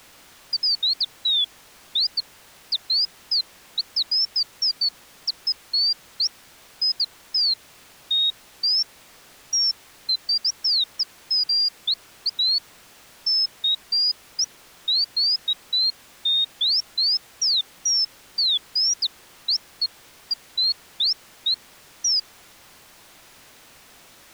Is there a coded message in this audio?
No, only bird-like chirps.